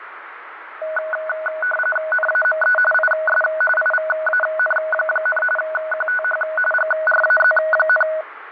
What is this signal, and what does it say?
RTTY (45.45 baud, 850 Hz shift), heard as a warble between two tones, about 1060 Hz centre, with radio static and fading. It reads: NAME IS IVAN, QTH GRAZ,